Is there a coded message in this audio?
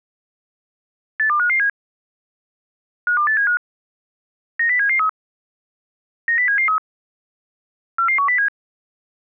Yes: five-tone selective call (CCIR) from 1.2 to 8.5 s, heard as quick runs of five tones, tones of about 100 ms. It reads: 82557 52875 90773 90773 44107